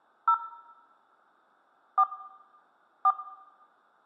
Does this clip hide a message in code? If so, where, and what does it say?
Yes: DTMF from 0.3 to 3.1 s, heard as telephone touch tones, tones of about 80 ms, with room echo. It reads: 0 4 4